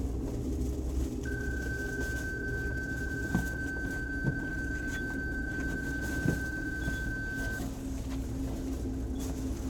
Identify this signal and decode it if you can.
PSK31 (31.25 baud), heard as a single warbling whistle, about 1550 Hz, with the noise inside a bus.